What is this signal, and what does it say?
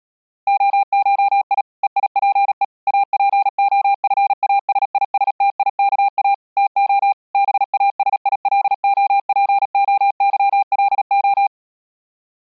Morse code (Greek alphabet), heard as a keyed tone, machine-sent, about 37 wpm, 800 Hz. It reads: ΟΧΙ ΕΙΠΕ ΑΠΟΦΑΣΙΣΤΙΚΑ ΤΟ ΒΑΣΙΛΟΠΟΥΛΟ